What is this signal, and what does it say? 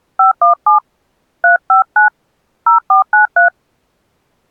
DTMF, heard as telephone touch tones, dialled by hand, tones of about 120 ms. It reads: 517 359 0493